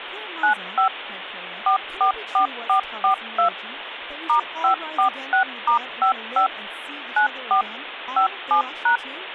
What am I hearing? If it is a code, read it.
DTMF, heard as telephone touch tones, dialled by machine, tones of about 100 ms, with phone line noise and speech in English. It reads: 95 444442 *546*55 94 57#